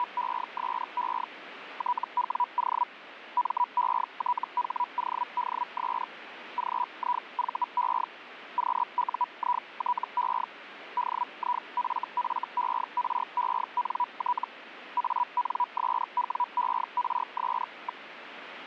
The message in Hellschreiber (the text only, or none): … TWO METHODS GIVE QUITE DIFFERENT ANSWERS.